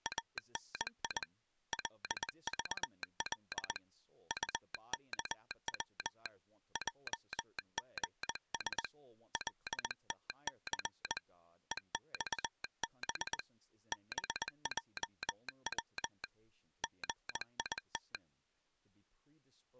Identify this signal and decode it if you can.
Morse code, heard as a telegraph sounder, hand-sent with a paddle, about 20 wpm, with speech in English. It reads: ANI LVL UKW JGS LTC EXB BJW GIT